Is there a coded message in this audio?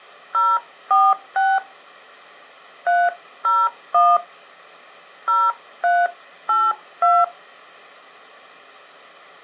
Yes: DTMF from 0.3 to 7.2 s, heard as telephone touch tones, dialled by hand, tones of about 220 ms. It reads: 046 301 0382